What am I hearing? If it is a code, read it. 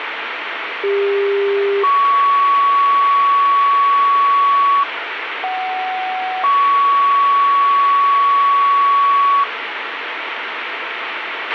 Two-tone page, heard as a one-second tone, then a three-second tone, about 400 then 1120 Hz, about 750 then 1120 Hz, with radio hiss and a squelch burst at the end.